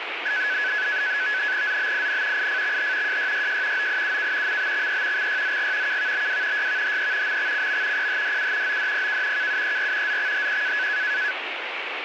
NAVTEX (SITOR-B), 100 baud, 170 Hz shift, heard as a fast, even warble, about 1600 Hz centre, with radio static. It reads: ZBIN IFXH JYYJ OIUK MBXE XYZG KVBW YVHE MXCM PHDU ODPK KUER ZXHQ